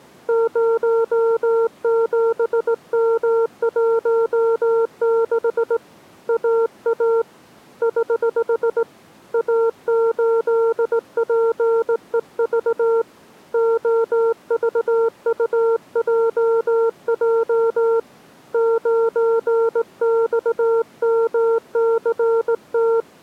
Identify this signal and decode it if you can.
Morse code, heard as a keyed tone, hand-sent with a straight key, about 18 wpm, 460 Hz. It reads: 07M16 AA <HH> A8PEV OVUJJ 9XMCT